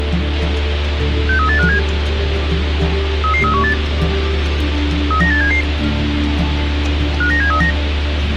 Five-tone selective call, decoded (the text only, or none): 63857 33318 39877 59739